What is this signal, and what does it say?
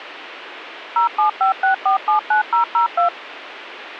DTMF, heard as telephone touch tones, dialled by machine, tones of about 120 ms, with radio hiss and a squelch burst at the end. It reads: 0756479002